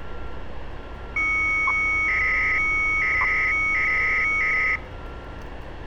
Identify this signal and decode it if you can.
300-baud modem data (Bell 103 tones), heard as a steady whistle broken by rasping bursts, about 300 baud, 200 Hz shift, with street noise.